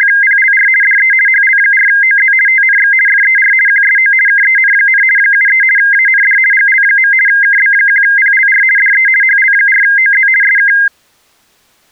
RTTY (50 baud, 450 Hz shift), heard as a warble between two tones, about 1850 Hz centre. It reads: … DE HL4OZ TNX FER QSO KEN, 73 AND GL. KB1PLR DE HL4OZ SK